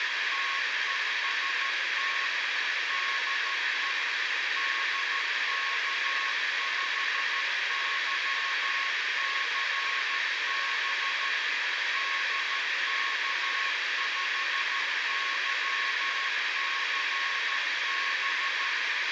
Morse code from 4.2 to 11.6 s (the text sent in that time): DK5YCB